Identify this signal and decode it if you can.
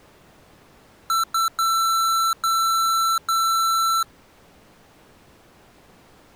Beep code, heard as beeps from a small speaker, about 1340 Hz. 2 short, 3 long.